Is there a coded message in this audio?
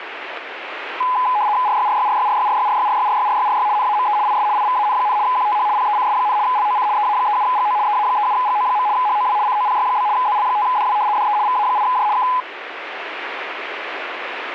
Yes: RTTY (75 baud, 170 Hz shift) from 1.0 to 12.4 s, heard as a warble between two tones, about 920 Hz centre, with radio static. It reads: RYRYRYRYRYRYRYRYRYRY NAME IS IVAN, QTH PECS, LOC EA37GO EA37GO. HOW COPY? ZL5DW DE VA8J K